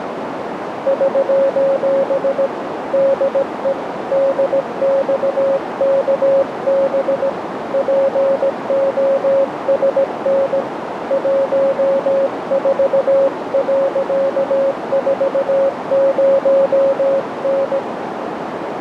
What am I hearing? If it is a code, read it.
Morse code, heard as a keyed tone, hand-sent with a paddle, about 17 wpm, 550 Hz, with radio static and a narrow filter. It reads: <SOS> DE DXKB POSN 14.40N